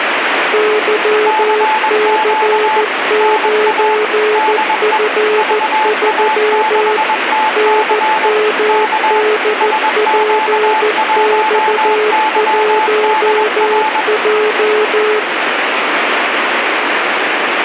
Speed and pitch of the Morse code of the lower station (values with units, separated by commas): 14 wpm, 430 Hz